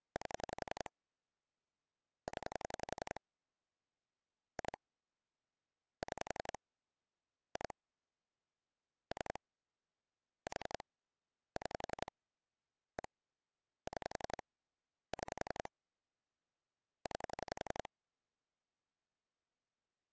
Pulse dialling, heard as clicks on a phone line, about 11 pulses a second. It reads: 8 0 2 6 2 3 4 6 1 6 6 9